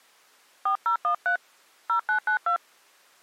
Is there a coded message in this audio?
Yes: DTMF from 0.7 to 2.6 s, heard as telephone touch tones, dialled by hand, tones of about 100 ms. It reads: 4013 0992